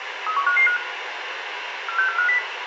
Five-tone selective call (CCIR), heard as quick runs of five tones, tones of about 100 ms, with radio hiss, a squelch burst at the end and room echo. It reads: 31555 46450